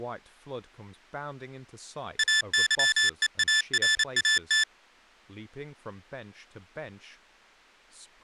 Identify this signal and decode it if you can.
Morse code (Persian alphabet), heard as electronic beeps, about 28 wpm, 1750 Hz, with speech in English. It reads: اظهارات